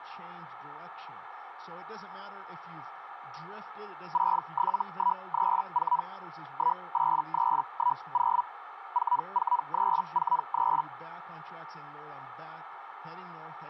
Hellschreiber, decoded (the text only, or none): 67134 18310 44343